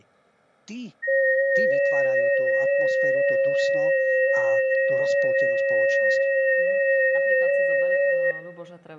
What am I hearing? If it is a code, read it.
FT8 (several signals at once), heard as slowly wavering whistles, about 6.25 baud, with speech in Slovak.